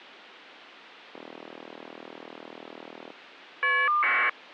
Caller ID data burst, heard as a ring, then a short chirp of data, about 1200 baud.